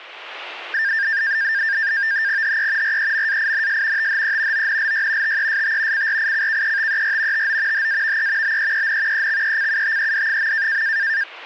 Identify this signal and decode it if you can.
NAVTEX (SITOR-B), 100 baud, 170 Hz shift, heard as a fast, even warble, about 1700 Hz centre. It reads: HE REMAINS THE ONLY TEST CRICKETER TO HAVE BEEN EXECUTED.